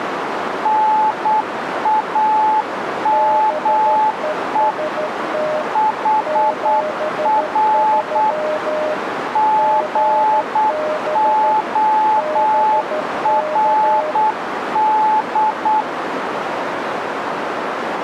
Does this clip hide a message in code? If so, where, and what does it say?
Yes: Morse code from 0.6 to 15.9 s, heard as two keyed tones, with radio static and a narrow filter. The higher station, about 8 wpm, 860 Hz: NAME HR GORD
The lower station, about 13 wpm, 610 Hz: BEST 73 GB BK